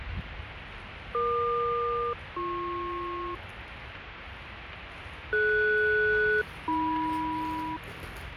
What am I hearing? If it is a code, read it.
Aircraft SELCAL, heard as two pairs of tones, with radio static, fading and the noise of a park. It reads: EQ-BP DS-AM